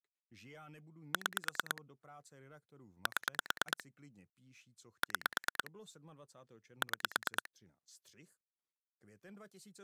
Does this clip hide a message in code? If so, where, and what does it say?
Yes: pulse dialling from 1.1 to 7.5 s, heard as clicks on a phone line, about 9 pulses a second, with speech in Czech. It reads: 6 7 6 6